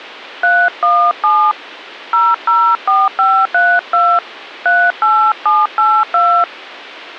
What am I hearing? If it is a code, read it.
DTMF, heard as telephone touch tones, dialled by hand, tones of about 240 ms. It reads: 317 004532 38782